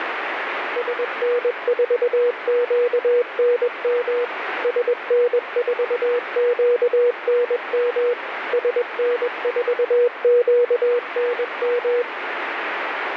Morse code, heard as a keyed tone, machine-sent, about 21 wpm, 480 Hz, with radio static. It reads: SN4QNM SN4QNM SN4QNM